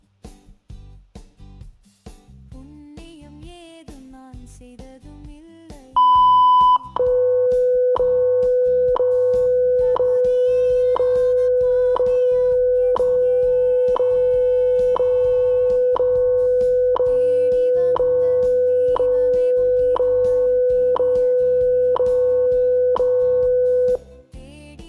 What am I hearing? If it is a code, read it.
Radio time signal (WWV, Colorado), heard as ticks, one a second.